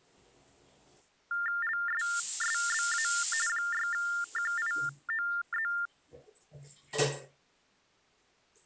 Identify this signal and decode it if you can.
TTY/TDD text telephone tones (45.45 baud Baudot), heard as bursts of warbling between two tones, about 400 Hz shift, 1600 Hz centre, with the noise of a restroom. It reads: LSSBA 6QIOZ